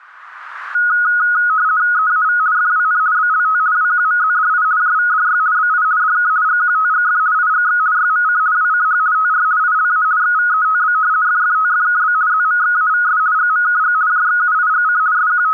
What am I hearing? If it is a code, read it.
RTTY (50 baud, 170 Hz shift), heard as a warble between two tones, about 1360 Hz centre. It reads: EAV FWN BLT WQMZDI JVDY BI DK GQTGF IGX YMC WCH TR ILA XVETB FFTFKB ZMXAVS GMKG JXUIGC …